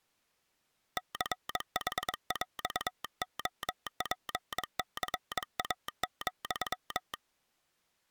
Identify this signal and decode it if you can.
Morse code (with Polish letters), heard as a telegraph sounder, hand-sent with a paddle, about 22 wpm. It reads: CHŁOPCA,